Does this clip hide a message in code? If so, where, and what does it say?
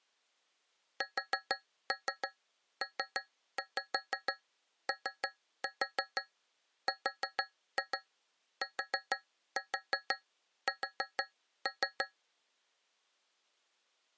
Yes: tap code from 1.0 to 12.2 s, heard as taps on a metal pipe, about 6 knocks a second. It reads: SPORTS